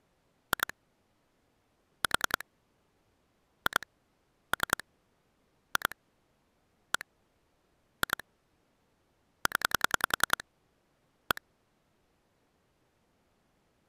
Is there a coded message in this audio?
Yes: pulse dialling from 0.5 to 11.4 s, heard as clicks on a phone line, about 10 pulses a second. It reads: 2 4 2 3 2 1 2 0 1